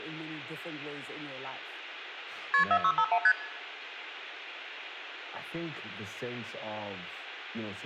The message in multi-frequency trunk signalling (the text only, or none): KP 4651 ST